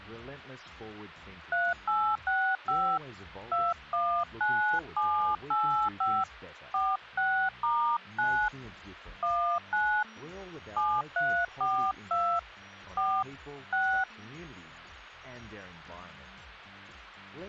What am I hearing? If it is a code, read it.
DTMF, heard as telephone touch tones, dialled by hand, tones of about 300 ms. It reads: 3865 219785 46*9 19 7342 4 6